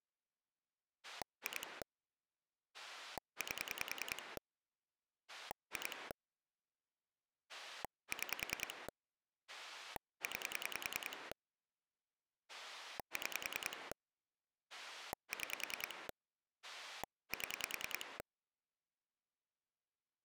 Pulse dialling, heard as a rotary dial, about 10 pulses a second. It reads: 2 8 2 6 9 6 6 7